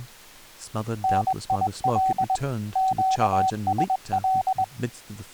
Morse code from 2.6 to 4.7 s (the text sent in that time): QSL